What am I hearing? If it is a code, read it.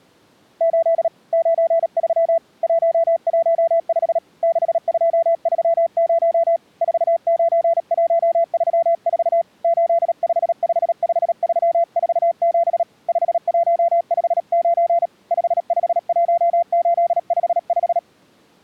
Morse code, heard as a keyed tone, hand-sent with a paddle, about 37 wpm, 680 Hz. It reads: 8 93 115 6230 49134 8555347 5159 551855